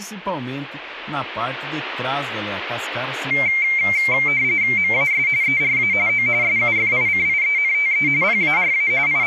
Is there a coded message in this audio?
Yes: RTTY (45.45 baud, 170 Hz shift) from 3.3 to 9.3 s, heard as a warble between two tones, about 2200 Hz centre, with speech in Portuguese. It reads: MAS ERA O SUFICIENTE PARA …